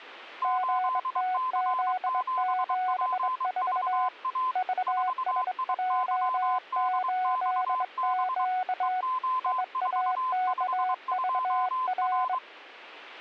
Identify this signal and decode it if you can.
Morse code, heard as two keyed tones. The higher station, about 23 wpm, 1030 Hz: 8C7PVA 4IYDXB EO452R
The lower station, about 22 wpm, 740 Hz: GTZ74 VSJ8Q IAKVR